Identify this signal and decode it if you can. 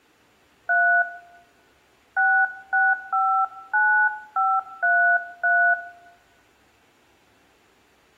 DTMF, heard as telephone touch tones, dialled by hand, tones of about 270 ms, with room echo. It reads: 3 6659533